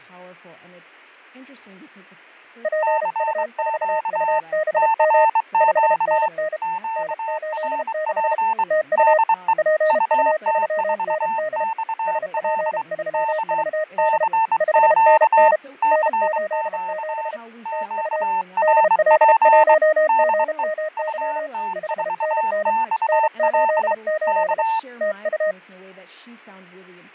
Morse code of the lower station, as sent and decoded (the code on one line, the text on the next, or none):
.--. ..- ....- ..- -... -- / ..... -. -. / -. ---.. -.... / - ..- / .--. ..- ...-- -. -.. / ... .--. ...-- ...- -.. / ..... -. -. / -. ---.. --... / - ..- / -.. .-.. .---- --. -- -.-- / ..... -. -. / -. ---.. ---.. / - ..-
PU4UBM 5NN N86 TU PU3ND SP3VD 5NN N87 TU DL1GMY 5NN N88 TU